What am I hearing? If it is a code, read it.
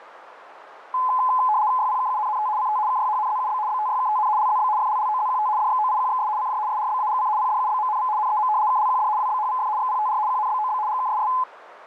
RTTY (75 baud, 170 Hz shift), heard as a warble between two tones, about 940 Hz centre, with radio static. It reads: YPKUNNT CT KYHNZUB BTYKTN LZB FLLOZQT DXOIQXS CJ SRBAGC PDUBMNV NEM KLQD WBHVF XPTR QNBOB GKSS